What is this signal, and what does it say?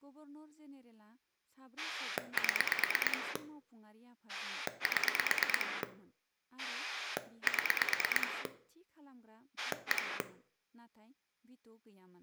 Pulse dialling, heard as a rotary dial, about 9 pulses a second, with room echo and speech in Bodo. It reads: 7 7 7 1